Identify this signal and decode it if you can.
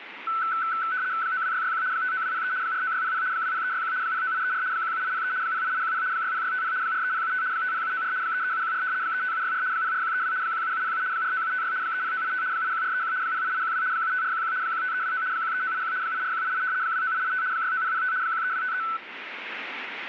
RTTY (75 baud, 170 Hz shift), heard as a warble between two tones, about 1410 Hz centre, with radio static. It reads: 92661 59203 49600 20361 09834 17803 08810 60650 43075 50794 33714 35764 04132 17707 49756 30985 81431 08812 75411 15329 13981 84188 29885 69005 13253